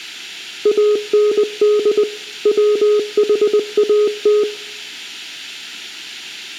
Morse code, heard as a keyed tone, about 20 wpm, 420 Hz, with room echo. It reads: AND WHAT